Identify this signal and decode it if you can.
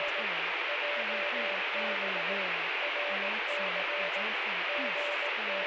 Morse code, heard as a keyed tone, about 18 wpm, 580 Hz, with heavy radio static and speech in English. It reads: … JB RC …